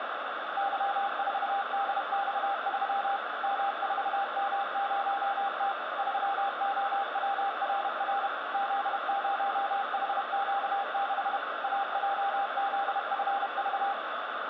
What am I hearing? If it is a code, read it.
Morse code, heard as a keyed tone, machine-sent, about 31 wpm, 800 Hz, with radio static. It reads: Y4DX3 M4M0T 3OWRR Z0HQ6 AJZFV